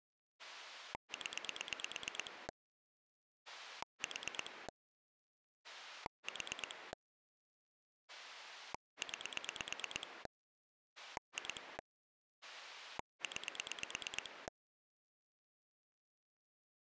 Pulse dialling, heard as a rotary dial, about 8 pulses a second. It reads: 0 4 4 9 2 9